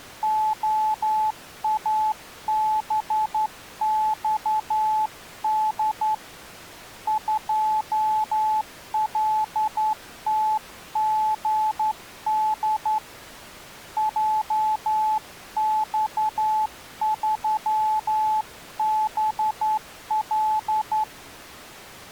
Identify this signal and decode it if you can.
Morse code, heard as a keyed tone, hand-sent with a straight key, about 11 wpm, 860 Hz. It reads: OABXD 2LTGD JX3BL